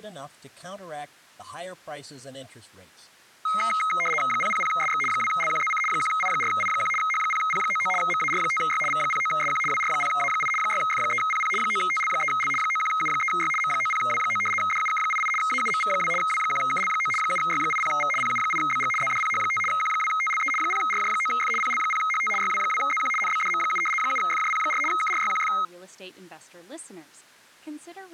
RTTY (75 baud, 850 Hz shift), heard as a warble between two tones, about 1700 Hz centre, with speech in English. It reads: 000SX 2LQZC 1I4I1 H0P99 MAR5Y V09SQ WR0A8 6F3PP 9TL3L 91U3Y M90W9 DUK88 AUMV2 W1KL9 7Y80V PU8BG ZDPH5 Q2TLE 0RJ9F PL0HT YW2ZQ NBDM7 7FJP4 KRYQF